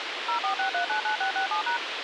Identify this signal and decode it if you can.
DTMF, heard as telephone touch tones, dialled by machine, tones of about 110 ms, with radio hiss. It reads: 046399667#